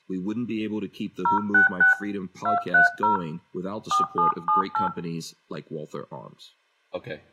DTMF, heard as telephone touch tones, dialled by hand, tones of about 130 ms, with room echo and speech in English. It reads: 066 230 4778